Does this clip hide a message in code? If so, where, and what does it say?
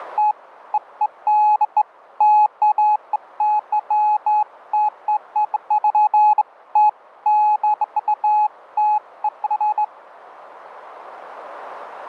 No, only beeps of irregular length.